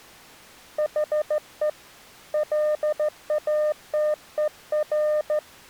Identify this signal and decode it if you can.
Morse code, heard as a keyed tone, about 14 wpm, 610 Hz. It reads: HE LATER